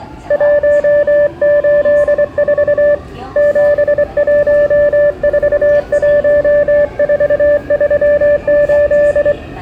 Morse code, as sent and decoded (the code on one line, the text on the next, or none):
.---- ---.. ....- / --... .---- ....- .---- ....- ...-- ---..
184 7141438